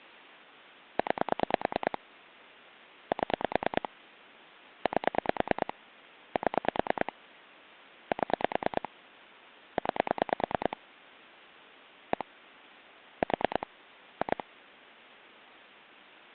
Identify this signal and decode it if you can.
Pulse dialling, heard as clicks on a phone line, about 9 pulses a second. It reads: 9 7 8 7 7 9 1 4 2